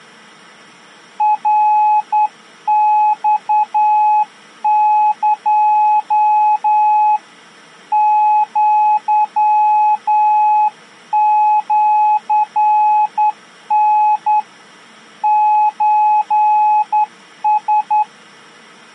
Morse code (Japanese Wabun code), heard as a keyed tone, hand-sent with a straight key, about 10 wpm, 850 Hz. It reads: ナマエ アシタ ソラ